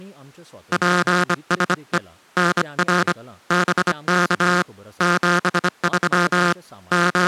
Morse code, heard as a buzzer, hand-sent with a bug key, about 25 wpm, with speech in Goan Konkani. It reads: PSE NR BK 73 …